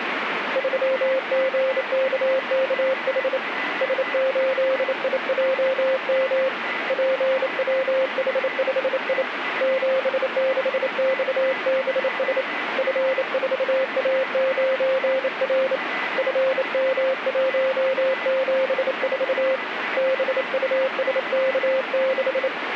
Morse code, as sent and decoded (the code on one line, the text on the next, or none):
...-- --. -.- -.- .... / ... ---.. .. .--- -- / .--. .-- .... ..... .. / --... -.... -..- -... ... / ..-. ....- .- ----. .-. / ..-. -- .---- --... ....- / -... ..- ... -.- -....
3GKKH S8IJM PWH5I 76XBS F4A9R FM174 BUSK6